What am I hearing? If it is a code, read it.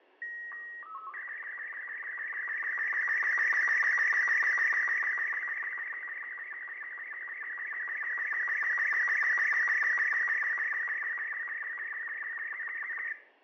SSTV (slow-scan television), Robot 36, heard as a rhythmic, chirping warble, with fading and room echo.